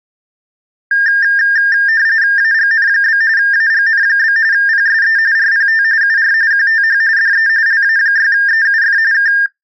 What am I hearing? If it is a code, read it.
RTTY (45.45 baud, 170 Hz shift), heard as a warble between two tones, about 1700 Hz centre. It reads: AGN? AGN? PSE RPT UR QTH DE LA6EUF K